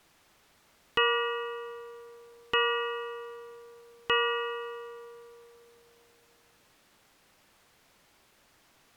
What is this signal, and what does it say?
Clock strike, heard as a bell. 3. Three o'clock.